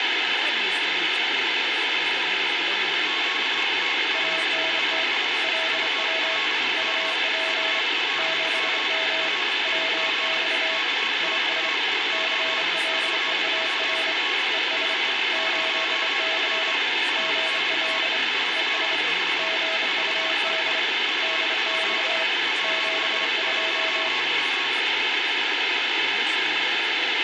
Morse code, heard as two keyed tones, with radio static and room echo. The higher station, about 25 wpm, 1100 Hz: QTH IS ULM ULM RIG KX2 PWR 50W ANT INV VEE UP 11M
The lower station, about 27 wpm, 650 Hz: ANT LW UP 7M WX IS CLEAR ES 8C GL ES GUD DX 72